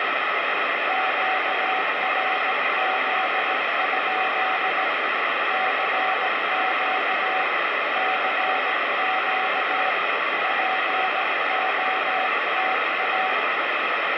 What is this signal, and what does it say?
Morse code, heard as a keyed tone, hand-sent with a paddle, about 17 wpm, 750 Hz, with heavy radio static. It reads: QRZ? CQ CQ POTA